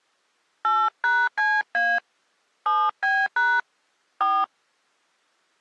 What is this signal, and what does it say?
DTMF, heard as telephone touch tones, dialled by hand, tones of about 240 ms. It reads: 8#CA 7B# 4